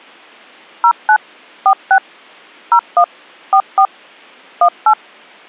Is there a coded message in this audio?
Yes: DTMF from 0.8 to 4.9 s, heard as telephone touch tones, dialled by machine, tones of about 80 ms. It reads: 09 46 01 44 18